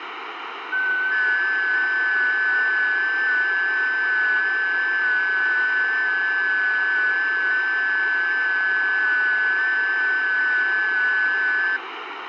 FT8 (several signals at once), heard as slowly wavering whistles, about 6.25 baud, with radio static and room echo.